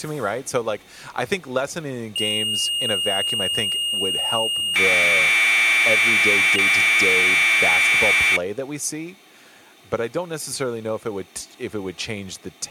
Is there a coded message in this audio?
Yes: Commodore tape loading (standard loader) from 2.2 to 8.4 s, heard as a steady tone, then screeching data, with speech in English.